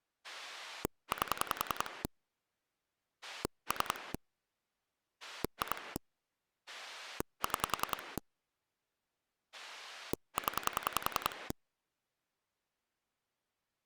Pulse dialling, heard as a rotary dial, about 10 pulses a second. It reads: 8 3 2 6 0